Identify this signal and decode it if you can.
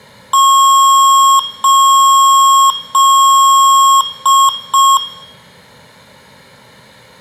Beep code, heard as beeps from a small speaker, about 1090 Hz, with room echo. 3 long, 2 short.